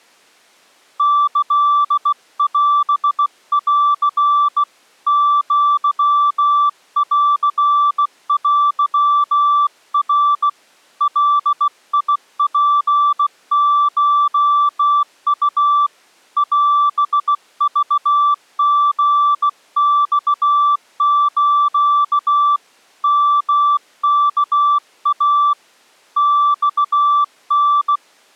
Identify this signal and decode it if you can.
Morse code (Japanese Wabun code), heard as a keyed tone, hand-sent with a bug key, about 16 wpm, 1160 Hz. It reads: キオン アンテナ ガツコウ オクリマス ヨワイ マタ